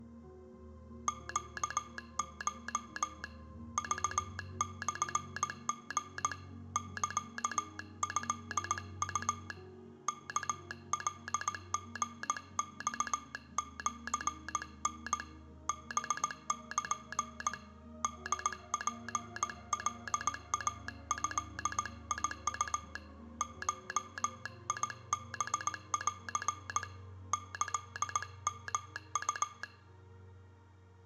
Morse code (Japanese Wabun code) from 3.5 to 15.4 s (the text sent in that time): クモリ サトウ ワカリマシタ